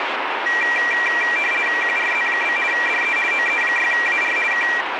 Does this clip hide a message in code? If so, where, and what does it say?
Yes: RTTY (50 baud, 450 Hz shift) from 0.5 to 4.8 s, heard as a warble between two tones, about 2150 Hz centre, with radio static. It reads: QRZ? DE OE6AR K